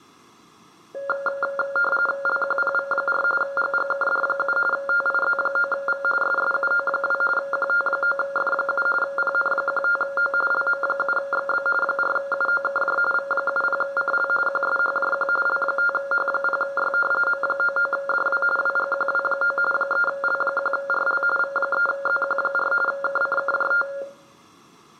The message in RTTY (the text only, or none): LQPV4 GGKD7 TIZ9V SSUO2 QT9F7 PN15O LM7XB 4UOKJ V70CL QSHJQ L5H0Y M99DW WGQW9 3L1RL V3ZQ4 KCKJT